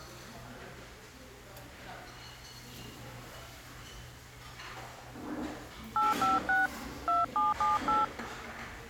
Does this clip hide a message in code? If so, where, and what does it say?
Yes: DTMF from 6.0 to 8.0 s, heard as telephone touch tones, dialled by hand, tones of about 170 ms, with the noise of a restaurant. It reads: 856 2778